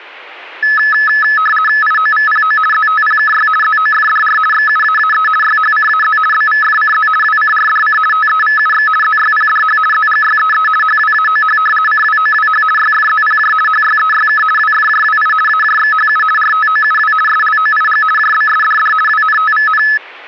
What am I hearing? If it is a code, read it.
RTTY (50 baud, 450 Hz shift), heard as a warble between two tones, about 1500 Hz centre. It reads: IOVPO ZTPKY ZOFDR XUAAE YHCAZ BVFCZ WCRDC TEVUX ZYPDH ZGYEE HWAOH CWOWH YFZPJ HYEYK WFJWI AJXHU RTOUW SLOIG JBSDD WNTVN